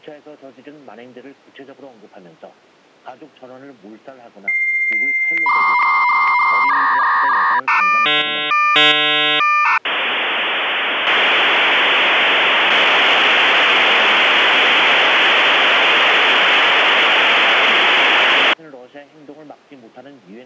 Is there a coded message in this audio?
Yes: dial-up modem handshake (V.34 or later) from 4.5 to 18.5 s, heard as a whistle, warbles, then hiss.